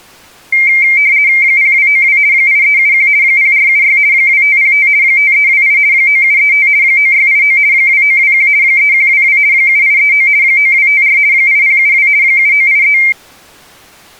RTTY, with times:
1.4-2.2 0292
2.3-3.1 8371
3.2-4.0 0476
4.1-4.9 2505
5.0-5.8 5328
5.9-6.7 9735
6.8-7.6 9689
7.7-8.5 2921
8.6-9.4 3122
9.5-10.3 7839
10.4-11.2 9254
11.3-12.1 8072
12.2-13.0 7983

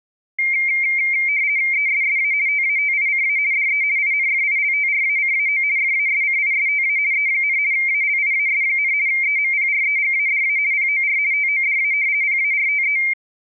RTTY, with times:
1.7-2.3 ESSA
2.5-3.4 TATICA
3.5-3.8 DE
4.0-5.6 INFILTRACAO
5.8-7.0 FASCISTA
7.1-7.6 E,
7.7-8.9 ALIAS,
9.1-10.6 EMPREGADA
10.7-11.2 POR
11.3-11.9 TODA
12.2-13.0 PARTE

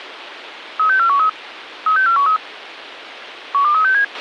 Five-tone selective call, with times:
0.8-1.3 36413
1.9-2.4 36413
3.5-4.0 12367

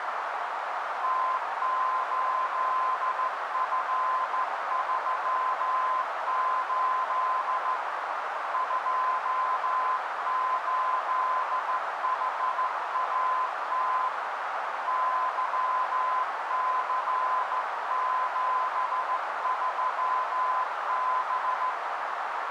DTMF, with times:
none

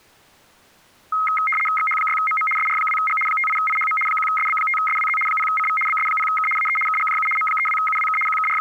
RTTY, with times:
1.8-2.5 XH6MM
2.6-3.2 SR2G
3.3-4.0 58IHM
4.1-5.2 1SB5SWZ
5.3-5.8 0CV
5.9-6.5 BS0K
6.6-6.8 AE
6.9-7.3 KGJU
7.4-8.2 M32UWK
8.3-8.6 …

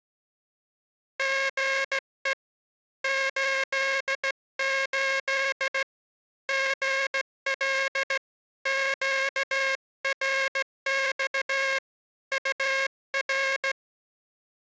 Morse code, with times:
1.2-2.3 GE
3.0-5.8 88
6.5-8.2 GL
8.7-11.8 QRX
12.3-13.7 UR

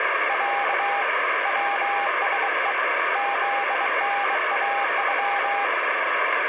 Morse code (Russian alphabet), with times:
0.3-1.0 Я
1.5-2.7 ВСЕ
3.2-5.6 ЗНАЮ

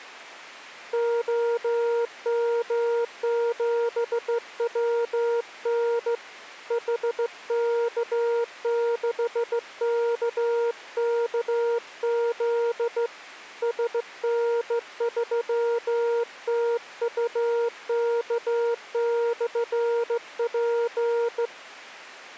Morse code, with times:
0.9-6.1 OM7WN
6.7-13.1 HK6KKZ
13.6-21.5 SN3TUK/P

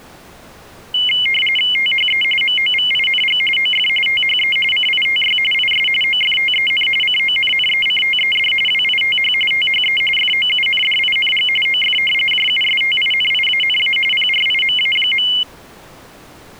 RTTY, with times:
1.8-2.2 THE
2.4-3.4 MOVING
3.6-3.9 OF
4.1-4.6 THE
4.7-5.4 CITY
5.5-5.9 IS
6.0-6.9 OFTEN
7.0-8.5 CONNECTED
8.7-9.3 WITH
9.5-10.0 THE
10.2-11.5 FOUNDING
11.7-12.0 OF
12.3-14.0 JUSTINIANA
14.1-15.3 PRIMA.

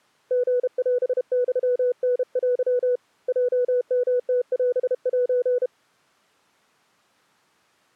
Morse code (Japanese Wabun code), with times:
0.3-3.0 リオユタテ
3.3-5.7 ヲヨムオセ

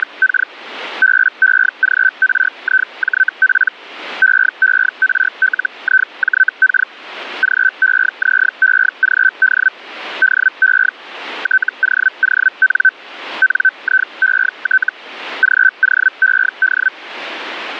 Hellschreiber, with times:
0.0-0.5 …
1.0-3.7 BEGRIJP
4.2-6.9 EERLIJK
7.4-9.7 GEZEGD
10.2-10.9 DE
11.4-12.9 TOON
13.4-14.9 NIET
15.4-16.9 GOED

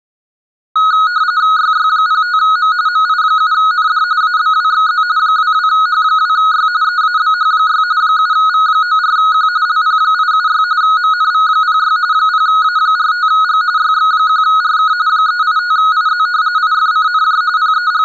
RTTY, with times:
1.6-2.7 YY05M
2.9-4.0 MI7ND
4.2-5.0 ABWXZ
5.2-6.7 22H2Y
6.8-7.8 EABH6
8.0-9.5 7V94Q
9.7-10.6 LP876
10.8-12.0 MNV06
12.1-13.6 0A45G
13.8-14.9 YX1RK
15.1-16.3 385IZ
16.6-17.4 IFCNJ
17.6-18.0 …

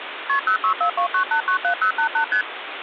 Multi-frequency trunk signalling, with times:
0.3-0.4 KP
0.5-2.2 06429897088
2.3-2.4 ST

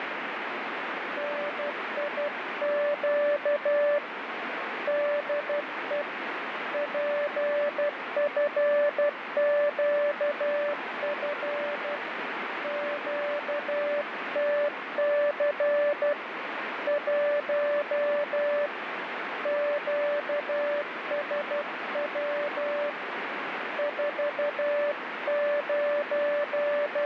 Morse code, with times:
1.2-4.0 NIQ
4.9-6.0 DE
6.7-12.0 PFQF
12.6-16.1 QTC
16.9-18.7 1
19.5-22.9 QSW
23.8-27.1 …

